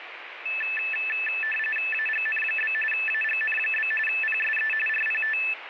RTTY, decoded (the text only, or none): AGN? AGN? PSE RPT